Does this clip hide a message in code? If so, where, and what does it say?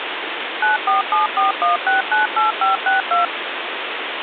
Yes: DTMF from 0.6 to 3.2 s, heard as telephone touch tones, dialled by machine, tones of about 140 ms, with phone line noise. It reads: 94741698562